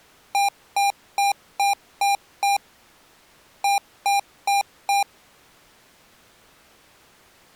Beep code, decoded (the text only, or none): 6-4